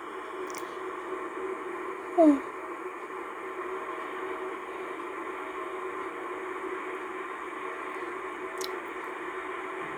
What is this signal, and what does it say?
The noise inside a car. There is no code.